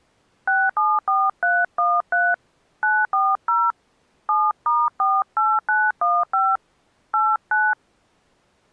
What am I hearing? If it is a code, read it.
DTMF, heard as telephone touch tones, dialled by hand, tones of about 220 ms. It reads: 674313 940 7*48915 89